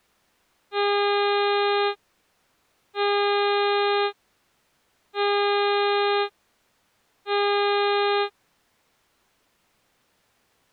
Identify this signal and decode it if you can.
Ship horn signal, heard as a ship's horn, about 410 Hz. 4 short. At sea: a pilot vessel's identity signal in fog.